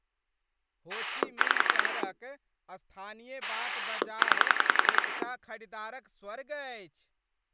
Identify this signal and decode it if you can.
Pulse dialling, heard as a rotary dial, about 10 pulses a second, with speech in Maithili. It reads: 5 9